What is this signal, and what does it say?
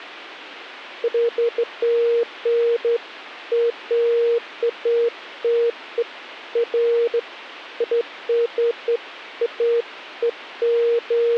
Beeps of irregular length. There is no code.